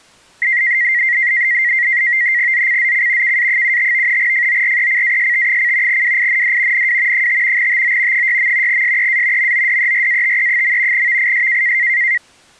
NAVTEX (SITOR-B), 100 baud, 170 Hz shift, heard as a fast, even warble, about 2000 Hz centre. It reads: ZCZC KA75 FORECAST: WIND NW 5 TO 6. SEA MODERATE. VIS